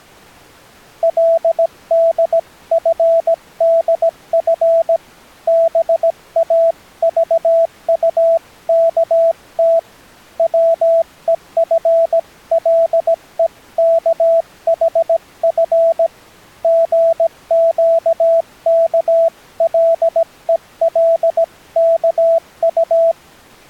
Morse code (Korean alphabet), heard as a keyed tone, hand-sent with a paddle, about 17 wpm, 660 Hz. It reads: 그는 도리어 반가운 생각이